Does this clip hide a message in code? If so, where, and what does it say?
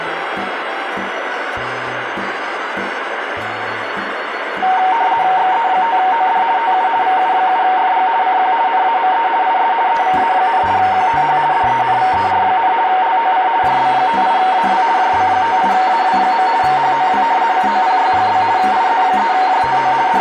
Yes: RTTY (50 baud, 170 Hz shift) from 4.6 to 20.2 s, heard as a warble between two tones, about 840 Hz centre, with radio static and room echo. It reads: XE5OD TU VU7FG CQ NAME IS EVA, QTH DENVER, LOC JB58AW JB58AW. HOW COPY? IZ3JTO …